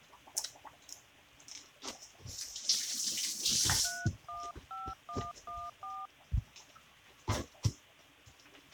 DTMF, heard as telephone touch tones, dialled by hand, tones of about 230 ms, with kitchen noise. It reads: 315114